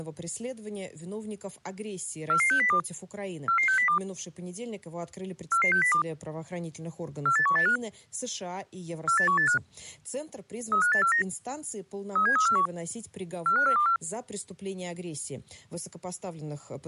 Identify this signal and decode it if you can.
Five-tone selective call (CCIR), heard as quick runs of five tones, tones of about 100 ms. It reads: 44602 44602 44602 48185 48185 35849 37341 45424